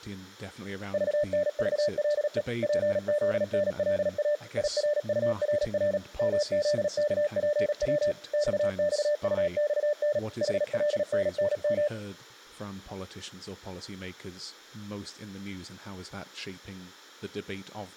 Morse code, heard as a keyed tone, machine-sent, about 37 wpm, 590 Hz, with room echo and speech in English. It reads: VNVLE PZNLA IRURR MZKPW XXUXN HLNNM